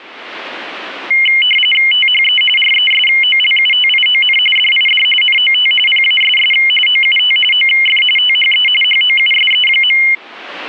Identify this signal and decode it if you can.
RTTY (45.45 baud, 850 Hz shift), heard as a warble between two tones, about 2550 Hz centre. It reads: THE RESOLUTION DID NOT PASS OUT OF THE HOUSE.